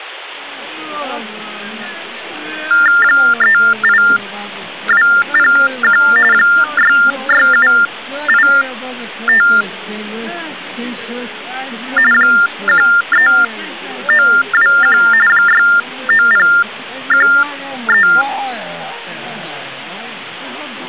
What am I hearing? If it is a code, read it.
TTY/TDD text telephone tones (45.45 baud Baudot), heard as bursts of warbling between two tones, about 400 Hz shift, 1600 Hz centre, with hum. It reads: 38201 66785 13921 69013